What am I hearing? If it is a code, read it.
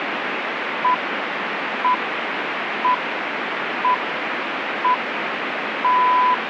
Radio time signal (six pips, as the Greenwich Time Signal), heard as pips, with radio static.